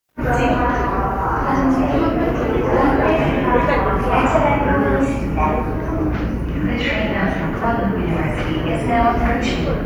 The noise of a subway station. There is no code.